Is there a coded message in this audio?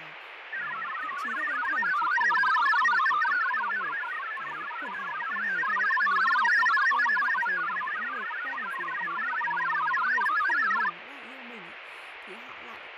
Yes: multi-tone FSK (Olivia or MFSK type), about 1000 Hz wide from 0.5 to 10.9 s, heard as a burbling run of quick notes, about 62.5 baud, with radio static, fading and speech in Vietnamese.